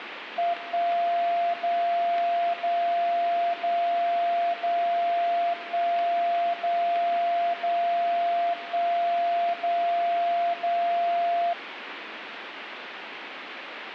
Radio time signal (DCF77), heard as a tone whose level steps once a second, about 690 Hz, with radio static. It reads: 1 0 0 0 0 1 0 0 1 0 0